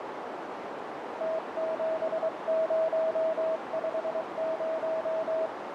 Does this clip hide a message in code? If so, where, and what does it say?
Yes: Morse code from 1.1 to 5.5 s, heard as a keyed tone, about 23 wpm, 640 Hz, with heavy radio static and a narrow filter. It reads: T7050